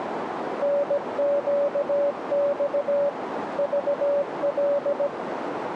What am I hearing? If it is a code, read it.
Morse code, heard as a keyed tone, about 17 wpm, 570 Hz, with radio static and a narrow filter. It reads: NQX VL